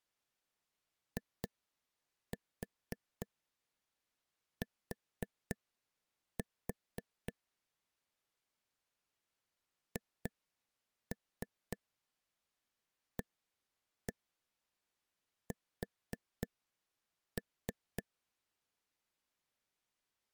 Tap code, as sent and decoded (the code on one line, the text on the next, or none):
2-4 4-4 / 2-3 1-1 4-3
IT HAS